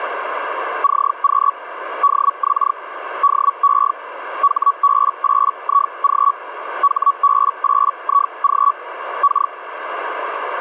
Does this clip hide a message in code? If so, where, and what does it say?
Yes: Hellschreiber (Feld-Hell, 122.5 baud) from 0.8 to 9.5 s, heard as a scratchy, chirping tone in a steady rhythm, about 1130 Hz, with radio static. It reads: CQ DX DE HB8IG HB8IG K